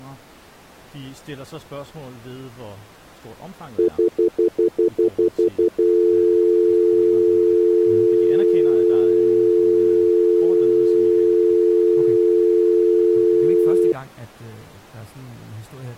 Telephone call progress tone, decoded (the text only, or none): stutter dial tone